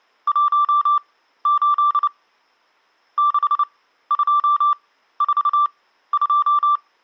Morse code, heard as a keyed tone, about 29 wpm, spaced as for 14 wpm, 1170 Hz. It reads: 18 6242